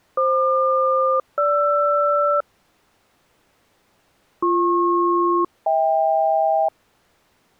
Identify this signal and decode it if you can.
Aircraft SELCAL, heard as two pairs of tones. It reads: FQ-GR BP-HK